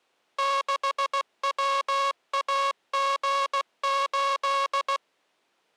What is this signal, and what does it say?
Morse code, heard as a buzzer, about 16 wpm. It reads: 6WAG8